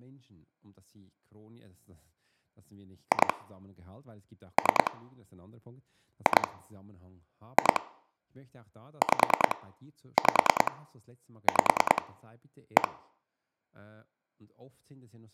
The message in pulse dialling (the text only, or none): 2 3 2 2 5 5 5 1